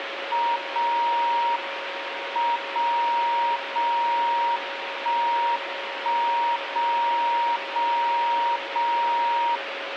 Radio time signal (WWVB), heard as a tone whose level steps once a second, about 940 Hz, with radio static and a steady whistle near 550 Hz. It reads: 0 M 0 0 1 1 0 0 0